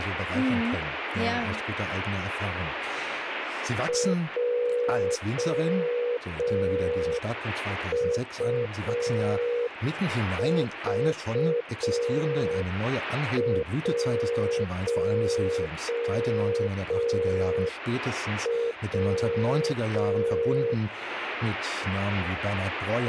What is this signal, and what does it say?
Morse code, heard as a keyed tone, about 5 wpm, 480 Hz, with radio static and speech in German. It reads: JUV1W